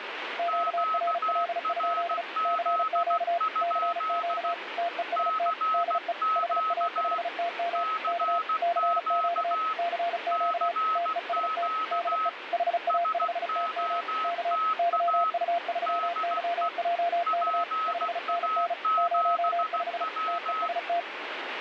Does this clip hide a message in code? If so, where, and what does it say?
Yes: Morse code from 0.3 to 21.1 s, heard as two keyed tones, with radio static. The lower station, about 35 wpm, 690 Hz: QRL? CQ CQ TEST DE HA5TM K CQ CQ TEST DE HA5TM K YU3YJK 5NN 05 TEST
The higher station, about 16 wpm, 1280 Hz: QRZ? CQ CQ CQ SOTA DE PA7W